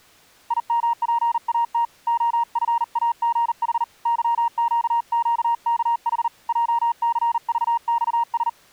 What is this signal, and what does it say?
Morse code, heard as a keyed tone, hand-sent with a paddle, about 39 wpm, 940 Hz. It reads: IMPAT OFAGH YQQKH JCVXS